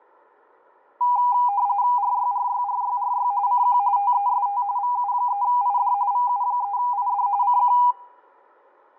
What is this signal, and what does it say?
RTTY (45.45 baud, 170 Hz shift), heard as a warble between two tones, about 890 Hz centre, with room echo. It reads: RYRYRYRY CQ TEST VU3ID VU3ID CQ